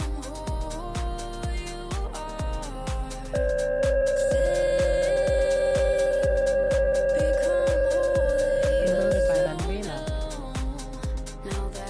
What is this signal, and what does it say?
PSK63 (62.5 baud), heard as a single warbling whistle, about 540 Hz, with room echo.